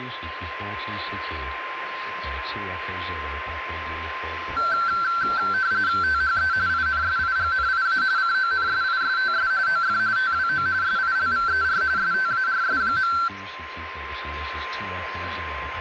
RTTY (45.45 baud, 170 Hz shift), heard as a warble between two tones, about 1450 Hz centre, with radio static and a steady whistle near 1040 Hz. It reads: THE INSIGNIA CONSISTS OF TWO SILVER STARS.